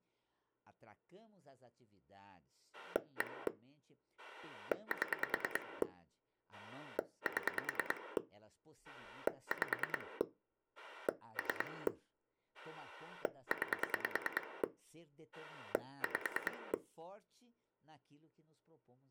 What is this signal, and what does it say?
Pulse dialling, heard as a rotary dial, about 9 pulses a second, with speech in Portuguese. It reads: 1 7 7 5 3 9 5